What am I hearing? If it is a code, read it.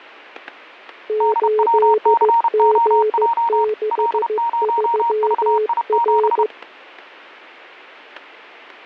Morse code, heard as two keyed tones, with static crashes. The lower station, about 15 wpm, 430 Hz: 8G63R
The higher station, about 31 wpm, 930 Hz: DWCOJ L0VI7